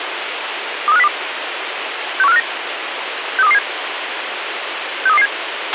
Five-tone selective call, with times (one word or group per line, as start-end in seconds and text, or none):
0.9-1.1 23502
2.2-2.4 61459
3.4-3.6 63227
5.1-5.3 63227